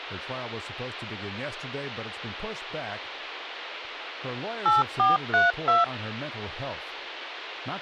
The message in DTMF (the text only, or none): 8432